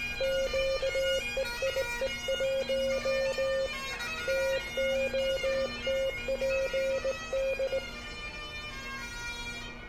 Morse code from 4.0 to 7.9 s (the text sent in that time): TOTPD